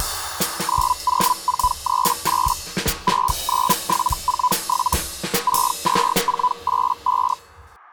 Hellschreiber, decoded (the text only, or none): 90438 69747 62485